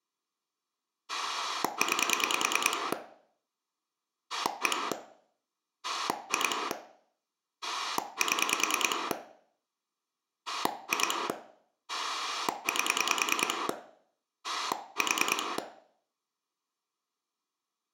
Pulse dialling, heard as a rotary dial, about 10 pulses a second, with room echo. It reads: 9 1 2 7 2 8 4